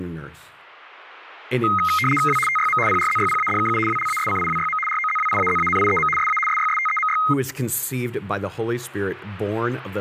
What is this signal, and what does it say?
RTTY (75 baud, 850 Hz shift), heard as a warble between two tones, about 1700 Hz centre, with speech in English. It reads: W TYM PRZYPADKU WLASCIWYM ROZWIAZANIEM SA SYSTEMY